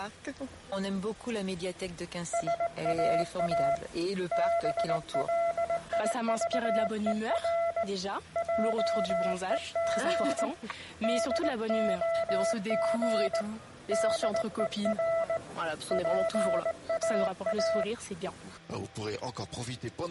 Morse code, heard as a keyed tone, hand-sent with a straight key, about 19 wpm, 670 Hz, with room echo. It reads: SAA BLIVER JEG DOG DER PAA